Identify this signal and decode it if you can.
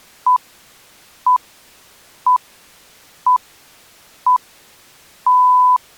Radio time signal (six pips, as the Greenwich Time Signal), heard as pips.